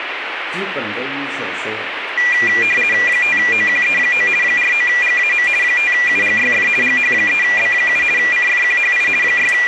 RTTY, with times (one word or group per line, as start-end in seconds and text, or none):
3.1-4.3 5OQE9
4.4-5.5 49GAM
5.6-6.7 5UGYF
6.8-8.0 GH3B7
8.2-9.1 CFQHI
9.2-9.7 …